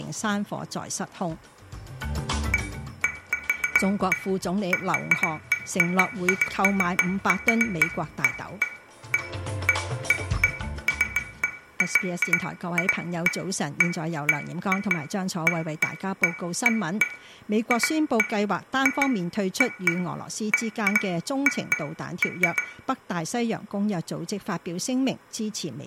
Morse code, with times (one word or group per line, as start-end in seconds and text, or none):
none